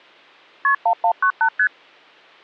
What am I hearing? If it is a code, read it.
Multi-frequency trunk signalling (R1, as on North American trunks), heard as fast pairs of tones, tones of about 80 ms. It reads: KP 1198 ST